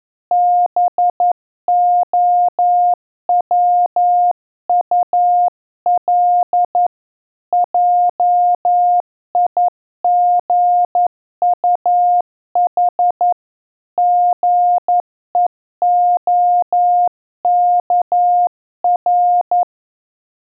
Morse code, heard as a keyed tone, hand-sent with a paddle, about 11 wpm, 710 Hz. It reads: BOWUL JIGUH GEOKR